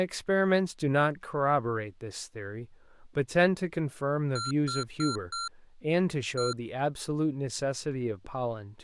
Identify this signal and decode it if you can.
Beep code, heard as beeps from a small speaker, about 1370 Hz, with speech in English. 4-1.